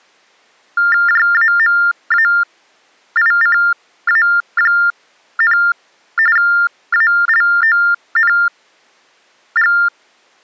TTY/TDD text telephone tones (45.45 baud Baudot), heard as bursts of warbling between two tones, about 400 Hz shift, 1600 Hz centre. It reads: JAMAICA, ALONG